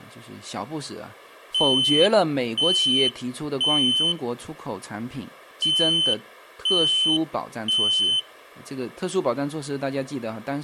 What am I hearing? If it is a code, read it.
Alarm pattern, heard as an alarm's beeps, played twice, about 3050 Hz, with speech in Chinese. Temporal three. Smoke or fire, evacuate.